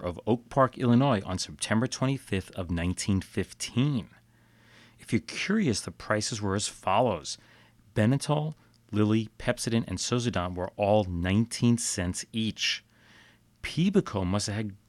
Speech in English. There is no code.